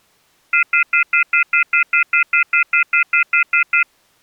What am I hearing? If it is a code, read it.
Telephone call progress tone (North American plan), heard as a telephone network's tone, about 1400, 2050, 2450, 2600 Hz, 0.1 s on and 0.1 s off. Off-hook warning tone.